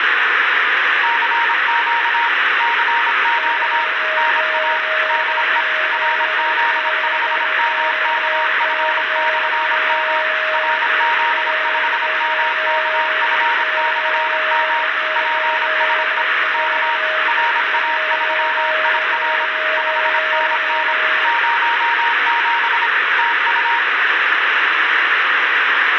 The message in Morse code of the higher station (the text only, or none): CQ CQ NA DE RZ5MKF/M RZ5MKF/M PSE K RA3IR 5NN 07 TU